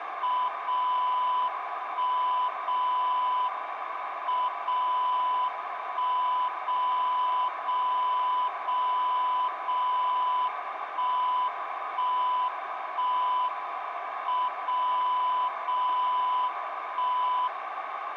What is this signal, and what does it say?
Radio time signal (WWVB), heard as a tone whose level steps once a second, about 1000 Hz, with radio static and a narrow filter. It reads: 0 1 0 M 0 1 0 0 0 0 1 1 1 M 0 0 1